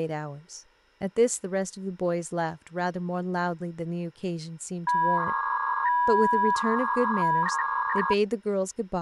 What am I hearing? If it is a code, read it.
300-baud modem data (V.21 tones), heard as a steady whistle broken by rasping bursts, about 300 baud, 200 Hz shift, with speech in English.